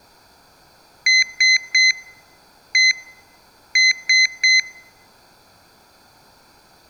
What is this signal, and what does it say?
Beep code, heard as a piezo beeper, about 2050 Hz, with room echo. 3-1-3. In Phoenix BIOS tables: interrupt mask register failure.